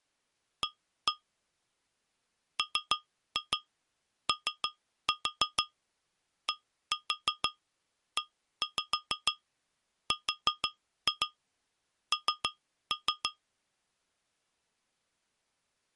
Tap code, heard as taps on glass, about 6 knocks a second. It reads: A MODERN